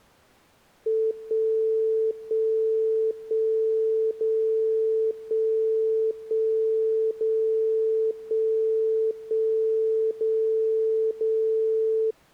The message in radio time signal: 1 1 1 0 1 1 0 1 1 0 0

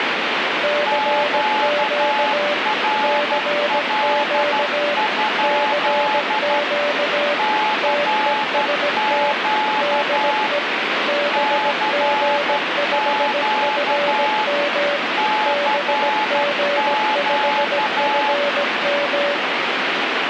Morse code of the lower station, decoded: CQ CQ CQ TEST DE BG5FM BG5FM

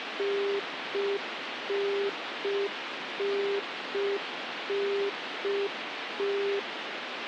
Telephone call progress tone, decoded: congestion tone

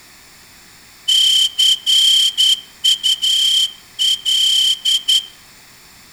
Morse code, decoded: CUL

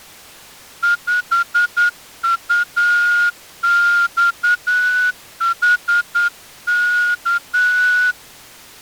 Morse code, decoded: 5UXHK

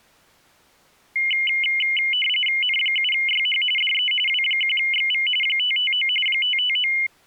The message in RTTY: N7YH DE W1XV 559 559

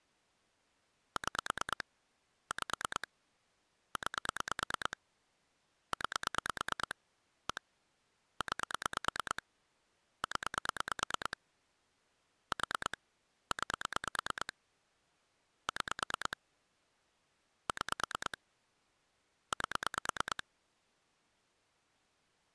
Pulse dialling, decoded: 6 5 9 9 1 9 0 4 9 6 6 8

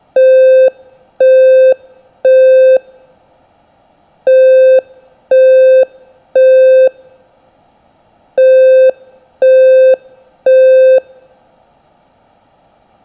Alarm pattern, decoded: temporal three

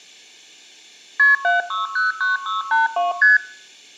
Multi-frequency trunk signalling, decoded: KP 7609682 ST

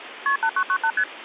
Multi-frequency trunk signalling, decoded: KP 8998 ST

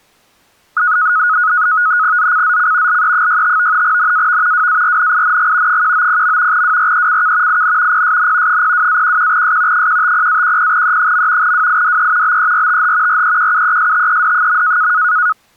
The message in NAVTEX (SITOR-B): ZCZC LE65 NAV WARNING 190. WRECK IN PSN 02-11S 150-10E. WIDE BERTH REQUESTED.

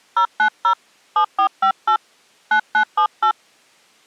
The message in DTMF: 090 7458 9978

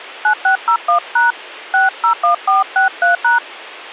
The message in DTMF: 9601# 601463#

